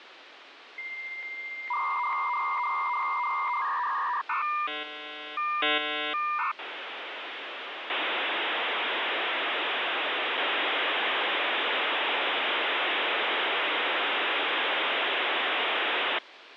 Dial-up modem handshake (V.34 or later), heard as a whistle, warbles, then hiss, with phone line noise.